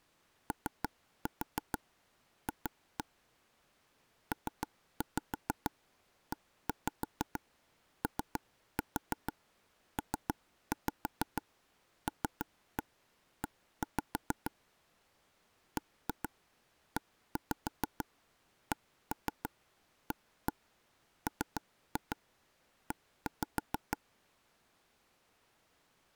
Tap code, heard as taps on a table, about 6 knocks a second. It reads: OF PEOPLE BECAME